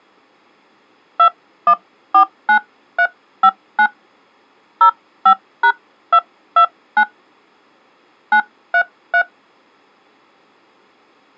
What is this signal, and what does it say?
DTMF, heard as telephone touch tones, dialled by hand, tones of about 70 ms. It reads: 2149359 05#229 933